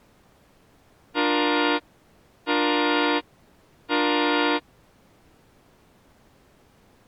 Train horn signal, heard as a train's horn. 3 short. On North American railways: when stopped, the train will back up.